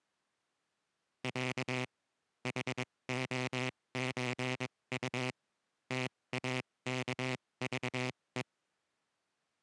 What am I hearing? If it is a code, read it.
Morse code (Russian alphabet), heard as a buzzer, machine-sent, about 22 wpm, spaced as for 18 wpm. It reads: Я ХОЧУ ТАКЖЕ